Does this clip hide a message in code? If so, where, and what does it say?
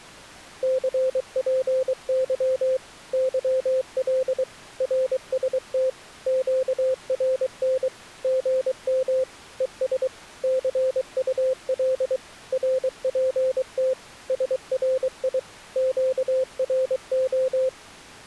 Yes: Morse code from 0.6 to 17.7 s, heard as a keyed tone, machine-sent, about 23 wpm, 520 Hz. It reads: CPY YL RST QRN GM ES CUL RPT SRI QRO